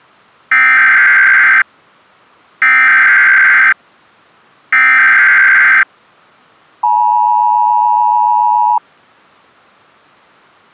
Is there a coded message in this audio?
Yes: Emergency Alert System (SAME) tones (header bursts, then the 853 and 960 Hz attention tone) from 0.5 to 8.8 s, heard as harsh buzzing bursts, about 520.83 baud.